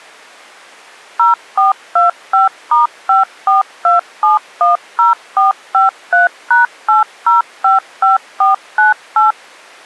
DTMF, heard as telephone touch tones, dialled by machine, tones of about 140 ms. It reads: 0425*542710453#8055498